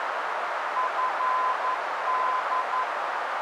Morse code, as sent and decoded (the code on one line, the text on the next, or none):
..-. -..
FD